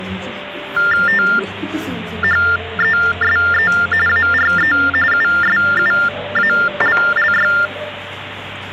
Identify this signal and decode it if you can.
TTY/TDD text telephone tones (45.45 baud Baudot), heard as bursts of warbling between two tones, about 400 Hz shift, 1600 Hz centre, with phone line noise and the noise of a restaurant. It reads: THESE ARE USUALLY